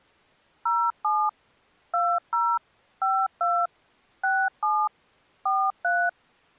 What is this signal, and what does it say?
DTMF, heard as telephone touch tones, dialled by machine, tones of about 250 ms. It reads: 07 20 52 67 43